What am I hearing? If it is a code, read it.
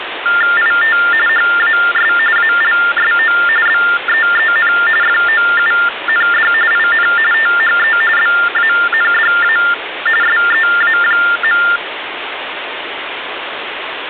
TTY/TDD text telephone tones (45.45 baud Baudot), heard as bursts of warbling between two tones, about 400 Hz shift, 1600 Hz centre, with phone line noise. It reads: IT HAS ALSO BEEN FOUND IN THE BANDA SEA.